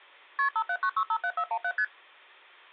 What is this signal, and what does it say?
Multi-frequency trunk signalling (R1, as on North American trunks), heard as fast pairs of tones, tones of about 70 ms. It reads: KP 579657417 ST